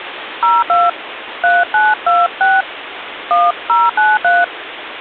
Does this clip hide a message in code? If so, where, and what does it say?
Yes: DTMF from 0.4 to 4.4 s, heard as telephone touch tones, dialled by hand, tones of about 200 ms, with phone line noise. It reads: 02 3926 1093